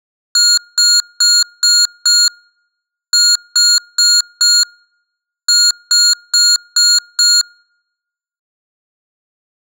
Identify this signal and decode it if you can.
Beep code, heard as beeps from a small speaker, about 1420 Hz, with room echo. 5-4-5.